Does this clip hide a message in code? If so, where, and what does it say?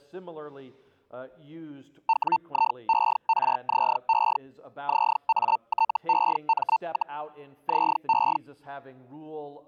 Yes: Hellschreiber (Feld-Hell, 122.5 baud) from 2.1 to 8.4 s, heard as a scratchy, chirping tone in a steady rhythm, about 900 Hz. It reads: WIERZE ZATEM, ZE